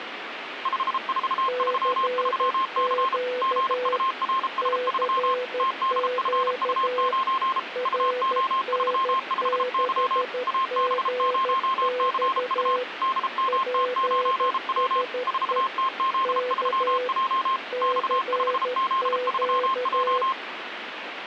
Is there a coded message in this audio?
Yes: Morse code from 0.6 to 20.4 s, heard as two keyed tones, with radio static. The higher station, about 33 wpm, 1060 Hz: 5433C GURS3 TDFU9 UO35Y AB0CU DMT9W 4TZ3J X5Z3J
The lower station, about 13 wpm, 500 Hz: CQ CQ RN6GX PSE K CQ